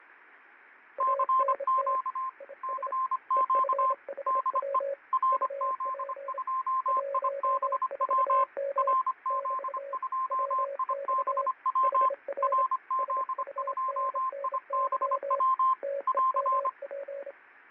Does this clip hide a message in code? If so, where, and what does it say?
Yes: Morse code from 0.9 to 17.4 s, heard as two keyed tones, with fading. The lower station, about 27 wpm, 560 Hz: ANT IS EFHW UP 14M <BT> WX HR SUNNY TEMP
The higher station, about 25 wpm, 1050 Hz: CQ CQ DE RZ2IBW RZ2IBW RZ2IBW <AR>